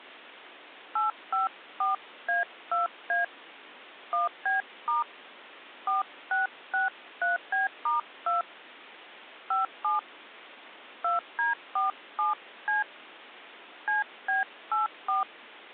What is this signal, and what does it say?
DTMF, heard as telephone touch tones, dialled by hand, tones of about 150 ms. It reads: 854A2A 1B* 4663B*2 57 2D47C CB84